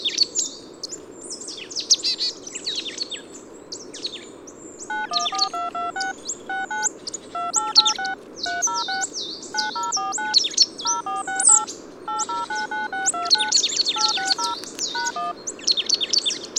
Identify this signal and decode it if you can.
DTMF, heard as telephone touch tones, dialled by machine, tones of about 160 ms. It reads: 914226 69 2886 306 9049 0468 8099629 860 #1